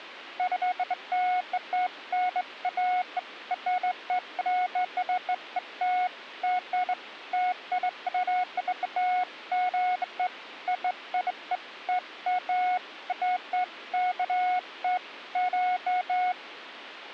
Beeps of irregular length. There is no code.